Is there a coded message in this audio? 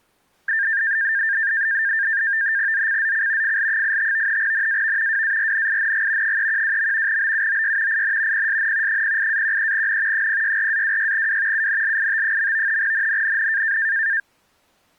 Yes: NAVTEX (SITOR-B), 100 baud, 170 Hz shift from 0.5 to 14.2 s, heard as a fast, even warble, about 1700 Hz centre. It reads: ZCZC FL85 NAV WARNING 312. BUOY IN PSN 08-13N 064-26W UNLIT. NNNN